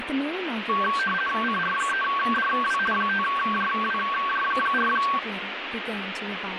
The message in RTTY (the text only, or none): CR3DW 5JWJ4